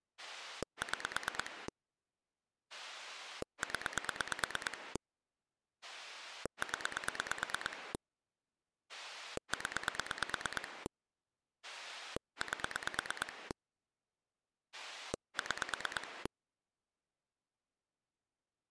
Pulse dialling, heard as a rotary dial, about 9 pulses a second. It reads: 6 0 0 0 8 6